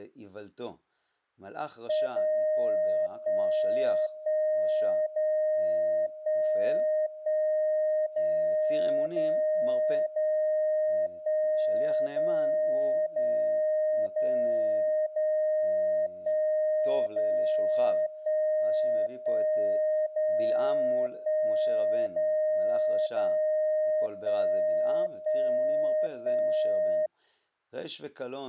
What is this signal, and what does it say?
Radio time signal (DCF77), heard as a tone whose level steps once a second, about 620 Hz, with speech in Hebrew. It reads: 0 1 1 0 1 1 0 0 0 1 0 0 0 0 1 0 1 1 0 1 0 0 1 1 1